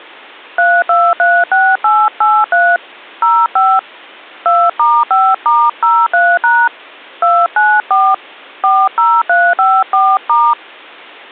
DTMF, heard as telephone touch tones, dialled by hand, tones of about 240 ms. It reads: 3236883 05 2*5*03# 294 40354*